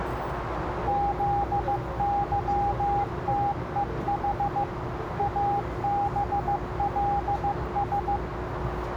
Morse code, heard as a keyed tone, machine-sent, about 15 wpm, 810 Hz, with radio static, a narrow filter and the noise inside a subway train. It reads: ZYTEH ABLS